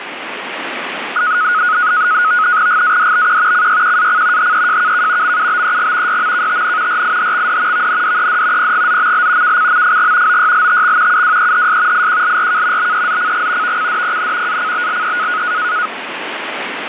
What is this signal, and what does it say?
NAVTEX (SITOR-B), 100 baud, 170 Hz shift, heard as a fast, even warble, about 1360 Hz centre, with radio static. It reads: GADBQ CYQAC HEJKK MUBEG YMKTN RIHXD VNDED PGZML KCMFG OYLTX UWEHS IQLRK BEZCG VCDPN ACBLE